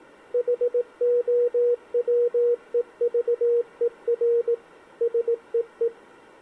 Morse code, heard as a keyed tone, machine-sent, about 18 wpm, 480 Hz. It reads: HOWEVER SEE